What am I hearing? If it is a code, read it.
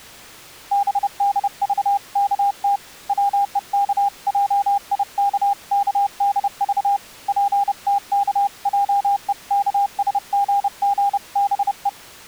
Morse code (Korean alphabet), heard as a keyed tone, hand-sent with a paddle, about 30 wpm, 800 Hz. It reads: 들어 방향을 정하였다